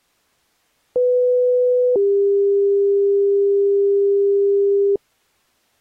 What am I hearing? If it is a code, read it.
Two-tone page, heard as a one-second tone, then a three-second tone, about 500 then 400 Hz.